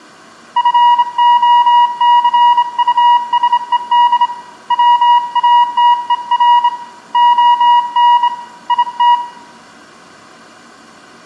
Morse code, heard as a keyed tone, hand-sent with a straight key, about 26 wpm, 960 Hz, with room echo. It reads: FOCUSED WATER ON IT